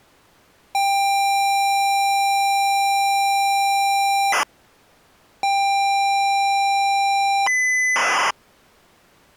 ZX Spectrum tape loading, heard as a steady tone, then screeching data.